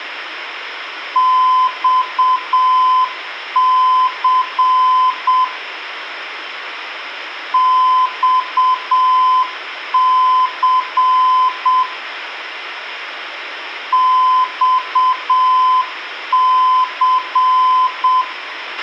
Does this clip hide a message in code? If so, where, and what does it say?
Yes: Morse code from 1.1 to 18.3 s, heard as a keyed tone, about 7 wpm, 1020 Hz, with a squelch burst at the end and room echo. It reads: XC XC XC